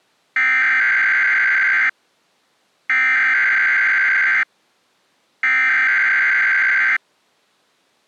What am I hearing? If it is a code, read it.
Emergency Alert System (SAME) tones (header bursts), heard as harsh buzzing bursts, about 520.83 baud.